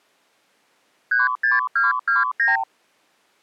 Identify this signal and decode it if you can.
Multi-frequency trunk signalling (R2, with the far end's replies), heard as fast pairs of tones, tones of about 160 ms. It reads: 36229